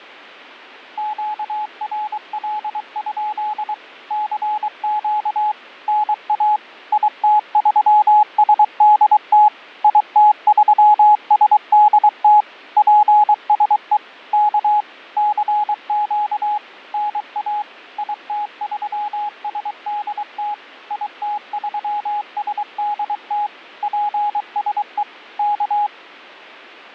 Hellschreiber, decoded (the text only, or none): none